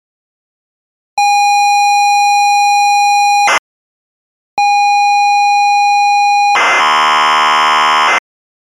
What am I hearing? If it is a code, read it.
ZX Spectrum tape loading, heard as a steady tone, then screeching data.